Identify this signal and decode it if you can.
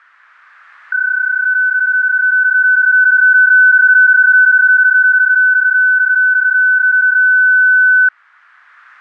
PSK31 (31.25 baud), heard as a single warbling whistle, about 1500 Hz.